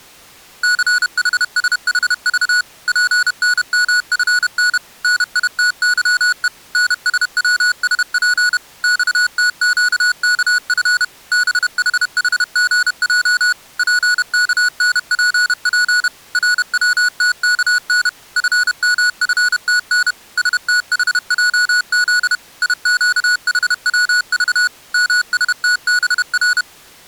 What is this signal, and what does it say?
Morse code, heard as electronic beeps, machine-sent, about 31 wpm, 1460 Hz. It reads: CHSHV PNMFN NITYE NSWSP XTQKF BHHGJ PKNPP RWTKN FMFTN STHJZ IQHWV MSTBR